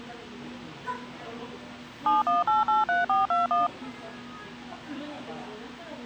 DTMF, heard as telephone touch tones, dialled by machine, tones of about 160 ms, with the noise of a cafe. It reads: 71883421